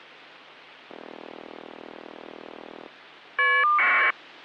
Caller ID data burst, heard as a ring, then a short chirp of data, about 1200 baud.